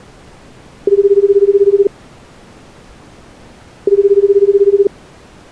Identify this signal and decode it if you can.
Telephone call progress tone (Japanese plan), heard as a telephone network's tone, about 380, 400, 420 Hz, 1 s on and 2 s off. Ringback tone.